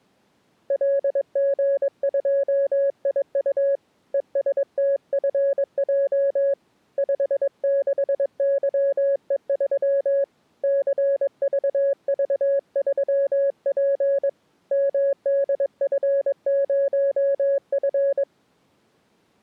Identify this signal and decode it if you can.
Morse code, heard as a keyed tone, hand-sent with a paddle, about 22 wpm, 560 Hz. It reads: LG2IU ESTFJ 56YE3 CVV3P MDF0F